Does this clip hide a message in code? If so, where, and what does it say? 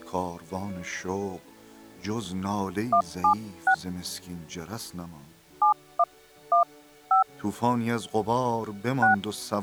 Yes: DTMF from 2.9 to 9.1 s, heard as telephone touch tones, dialled by hand, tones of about 90 ms. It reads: 176 7115 6